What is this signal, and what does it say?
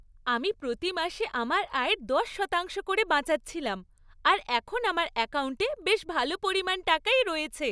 Speech in Bangla. There is no code.